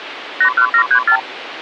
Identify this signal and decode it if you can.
Multi-frequency trunk signalling (R2, with the far end's replies), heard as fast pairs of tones, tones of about 80 ms, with phone line noise. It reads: 81734